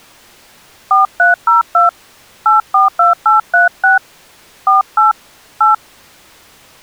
DTMF, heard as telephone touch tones, dialled by hand, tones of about 140 ms. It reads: 4302 842836 48 8